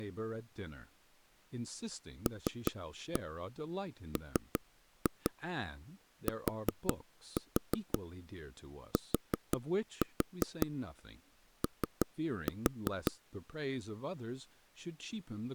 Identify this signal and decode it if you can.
Tap code, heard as taps on a table, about 5 knocks a second, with speech in English. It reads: LMTTO